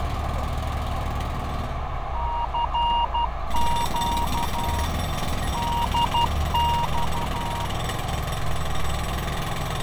Morse code, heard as a keyed tone, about 12 wpm, 940 Hz, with radio static, fading, a narrow filter and street noise. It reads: CQ DX